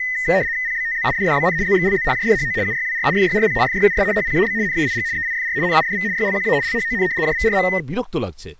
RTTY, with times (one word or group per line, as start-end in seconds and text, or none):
0.7-1.1 PBTZ
1.2-1.6 DDBN
1.7-2.1 ZXLZ
2.1-2.6 JDHO
2.7-3.1 UYWR
3.2-3.6 FYRP
3.7-4.0 FYUS
4.2-4.5 HPAB
4.7-5.1 NAIG
5.2-5.6 EIFR
5.7-6.1 NIDV
6.2-6.6 YLQA
6.7-7.1 LHON
7.2-7.7 JVRM